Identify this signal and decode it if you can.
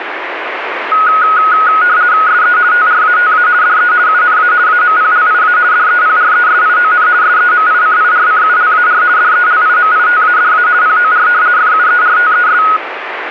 RTTY (50 baud, 170 Hz shift), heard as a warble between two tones, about 1360 Hz centre, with radio static. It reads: SE TRATA DE UNA AMPLIA DEPRESION SEMICIRCULAR DELIMITADA POR FUERTES